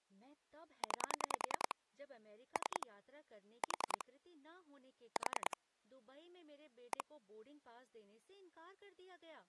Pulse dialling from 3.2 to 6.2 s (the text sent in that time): 4 4